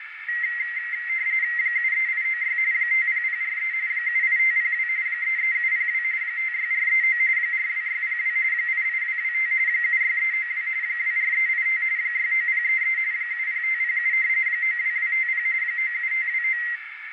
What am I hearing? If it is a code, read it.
RTTY (45.45 baud, 170 Hz shift), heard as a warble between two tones, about 2000 Hz centre, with radio static and a narrow filter. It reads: 73896 50043 78502 33702 56439 42602 88225 76392 24385 69033 70507 92250 97529